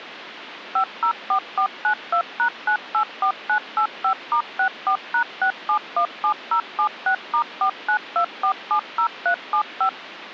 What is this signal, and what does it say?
DTMF, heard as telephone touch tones, dialled by machine, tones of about 90 ms, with phone line noise. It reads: 504492#984985*64#6717076*492470375